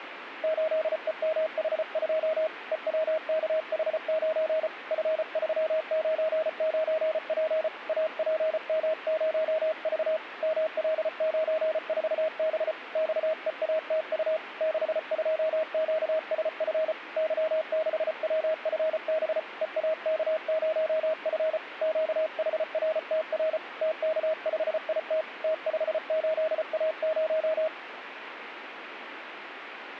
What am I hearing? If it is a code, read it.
Morse code, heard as a keyed tone, hand-sent with a paddle, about 34 wpm, 630 Hz, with radio static. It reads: 8EMH2 EWKH9 F399P APM0V ML94B XEATU 62QSF Y6WFB EAK0F QHRTR TK5IT T58A0